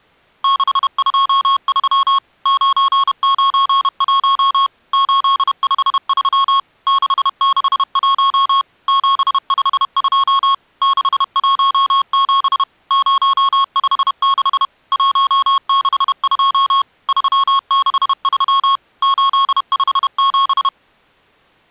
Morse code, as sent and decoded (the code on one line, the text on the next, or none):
-.... ..--- ...-- / ----. ----. .---- / ---.. ..... ...-- / -.... -.... .---- / --... ..... ..--- / -.... .---- --... / ----- ..... -.... / .---- -.... ..--- / ...-- -.... ...-- / ---.. ..... --...
623 991 853 661 752 617 056 162 363 857